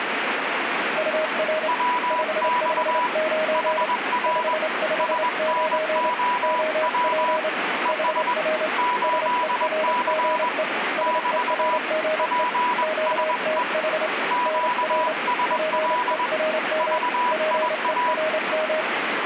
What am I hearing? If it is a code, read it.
Morse code, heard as two keyed tones, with radio static. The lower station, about 28 wpm, 630 Hz: UR 559 559 OP HR SERGE SERGE QTH NR PERM PERM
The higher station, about 21 wpm, 980 Hz: WX HR SNOW ES 8C <BT> PSE QSL VIA